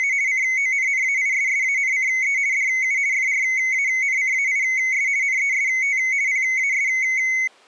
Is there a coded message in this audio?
Yes: RTTY (50 baud, 170 Hz shift) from 0.0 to 7.5 s, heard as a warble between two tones, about 2150 Hz centre. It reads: … CONNAISSANCE DU FRANCAIS NEST PAS